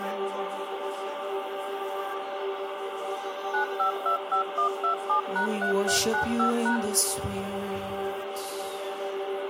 DTMF, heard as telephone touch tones, dialled by machine, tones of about 110 ms, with phone line noise. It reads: 9525127#3395#